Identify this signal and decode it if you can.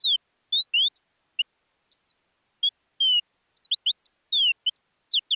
Bird-like chirps. There is no code.